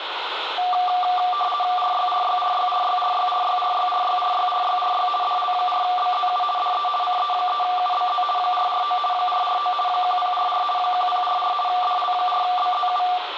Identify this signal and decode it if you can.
RTTY (50 baud, 450 Hz shift), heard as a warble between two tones, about 950 Hz centre, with radio static and room echo. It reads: RYRYRYRYRYRYRYRYRYRYRY DL4BZU DE CE3UBZ 449 449 1044 1044 DL4BZU